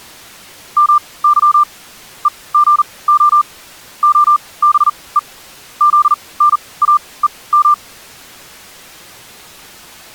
Morse code (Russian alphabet), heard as a keyed tone, machine-sent, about 40 wpm, spaced as for 23 wpm, 1190 Hz. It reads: МЫ ЕГО ОБЕ ЗНАЕМ